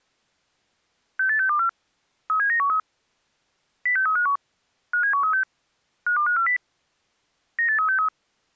Five-tone selective call (CCIR), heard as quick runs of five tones, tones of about 100 ms. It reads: 68624 37913 06351 57136 52540 98363